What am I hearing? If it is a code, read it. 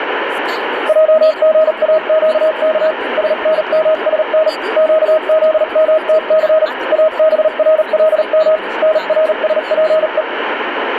Morse code (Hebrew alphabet), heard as a keyed tone, machine-sent, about 38 wpm, spaced as for 35 wpm, 630 Hz, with radio static, room echo and speech in Telugu. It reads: עגאקך שנמשן קזמתס אברלם נרשפו